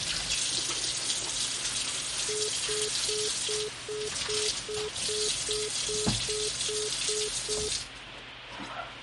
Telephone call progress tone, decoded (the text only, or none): congestion tone